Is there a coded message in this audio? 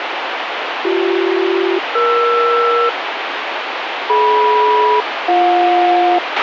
Yes: aircraft SELCAL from 0.8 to 6.2 s, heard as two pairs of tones, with radio hiss and a squelch burst at the end. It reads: BC-ER DM-BJ